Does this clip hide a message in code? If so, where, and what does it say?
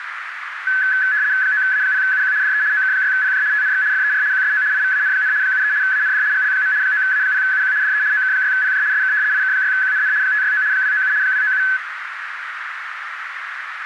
Yes: RTTY (75 baud, 170 Hz shift) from 0.7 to 11.8 s, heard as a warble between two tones, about 1600 Hz centre, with radio static and a narrow filter. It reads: 9A0UQ DE OK6PJ TNX FER QSO IVAN, 73 AND GL. 9A0UQ DE OK6PJ SK IK6QNN 569 297 297